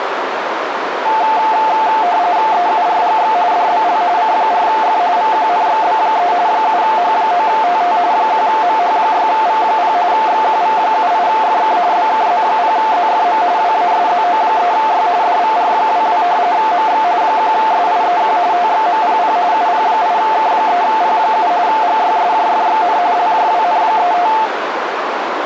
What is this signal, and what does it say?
RTTY (45.45 baud, 170 Hz shift), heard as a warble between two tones, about 790 Hz centre, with radio static and a narrow filter. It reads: EURGX DBL C4F VQNXB3 7H9TT 1MH6V0 XQV78FK BKZ0ZFM WASZO3Y DVR22 MX 1SIEQ TXMPP UP8K3P7 GYSJFXN LJWN35